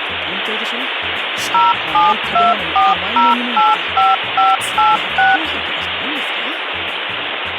DTMF, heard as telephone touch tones, dialled by machine, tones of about 180 ms, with phone line noise. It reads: 0724085586